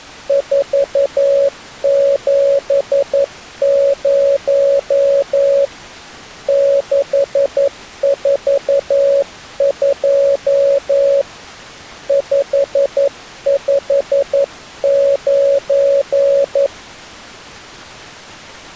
Morse code, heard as a keyed tone, hand-sent with a paddle, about 11 wpm, 560 Hz. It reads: 470 642 559